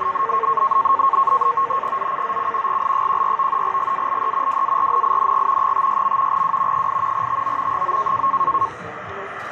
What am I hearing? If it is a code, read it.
NAVTEX (SITOR-B), 100 baud, 170 Hz shift, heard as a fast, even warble, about 1000 Hz centre, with radio static, a steady whistle near 1600 Hz and the noise of a subway station. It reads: ZCZC GL14 GALE WARNING 56. W 8 TO 9